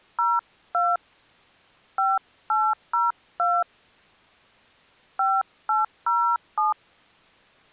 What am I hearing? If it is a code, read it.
DTMF, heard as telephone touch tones, dialled by hand, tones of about 220 ms. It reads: 02 5802 5807